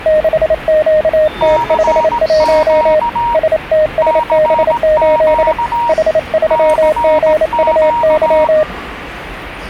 Morse code, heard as two keyed tones, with the noise of a subway station. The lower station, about 28 wpm, 610 Hz: 6QT51 STSB8 H3GUY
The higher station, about 18 wpm, 940 Hz: CQ CQ CQ